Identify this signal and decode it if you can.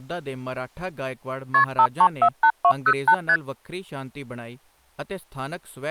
Multi-frequency trunk signalling (R1, as on North American trunks), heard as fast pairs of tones, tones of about 70 ms, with speech in Punjabi. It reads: KP 5348208 ST